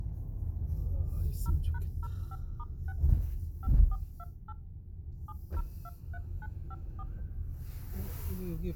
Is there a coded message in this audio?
Yes: DTMF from 1.5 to 7.0 s, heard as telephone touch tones, dialled by machine, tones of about 40 ms, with the noise inside a car. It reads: 0#05*6 5428 7023954